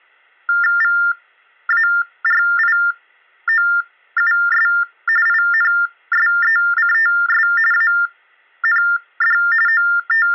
TTY/TDD text telephone tones (45.45 baud Baudot), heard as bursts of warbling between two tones, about 400 Hz shift, 1600 Hz centre, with hum. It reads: VARIOUS INSECTS AND …